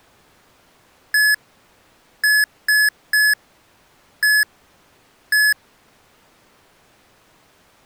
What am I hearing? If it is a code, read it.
Beep code, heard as beeps from a small speaker, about 1700 Hz. 1-3-1-1. In Phoenix BIOS tables: memory refresh test failure.